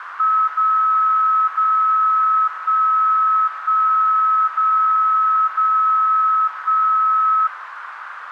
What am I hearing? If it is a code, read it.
Radio time signal (DCF77), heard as a tone whose level steps once a second, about 1290 Hz, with radio static and a narrow filter. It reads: 0 0 1 1 0 0 1